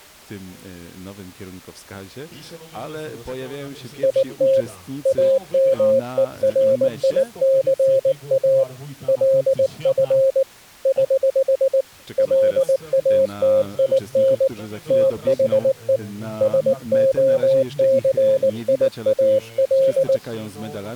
Morse code, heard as a keyed tone, hand-sent with a paddle, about 19 wpm, 540 Hz. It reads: IT AMERICA LF <HH> LATIN THE SOCIAL